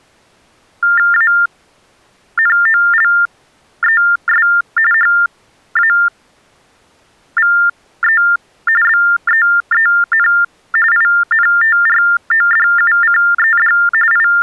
TTY/TDD text telephone tones (45.45 baud Baudot), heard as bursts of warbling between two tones, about 400 Hz shift, 1600 Hz centre. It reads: ANOLES HAVE BEEN INTRODUCED …